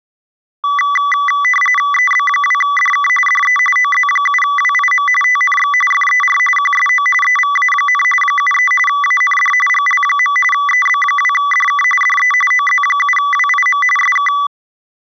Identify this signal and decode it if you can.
RTTY (45.45 baud, 850 Hz shift), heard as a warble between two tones, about 1550 Hz centre. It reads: EB2DK DE OZ7WIM TNX FER QSO EVA, 73 AND GL. EB2DK DE OZ7WIM SK